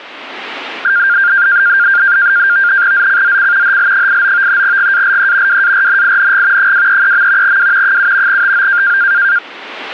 NAVTEX (SITOR-B), 100 baud, 170 Hz shift, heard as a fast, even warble, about 1500 Hz centre. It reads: ZCZC HL89 GALE WARNING 233. W 7 TO